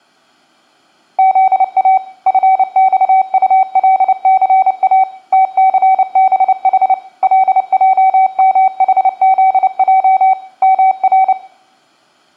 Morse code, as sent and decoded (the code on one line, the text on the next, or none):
--.. .- / ..-. -..- ..- .-.. -.-. .- / - -.-. -... .... / .-.. .--- -- .... --.. .--- / -- .-.
ZA FXULCA TCBH LJMHZJ MR